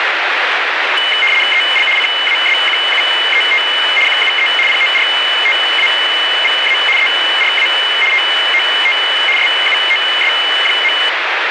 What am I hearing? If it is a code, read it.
RTTY (75 baud, 850 Hz shift), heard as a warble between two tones, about 2550 Hz centre, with radio static. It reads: EL CASQUET QUE PORTAVA ERA TOT SUOS.